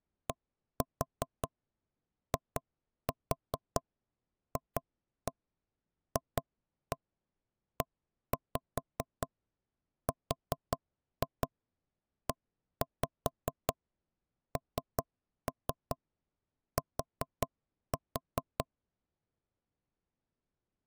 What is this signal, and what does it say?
Tap code, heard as knocks on wood, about 5 knocks a second. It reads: DIFFERENT